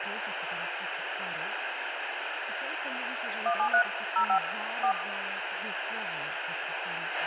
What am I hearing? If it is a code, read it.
DTMF, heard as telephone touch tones, dialled by machine, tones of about 90 ms, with radio hiss, a squelch burst at the end, room echo and speech in Polish. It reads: 173 05 4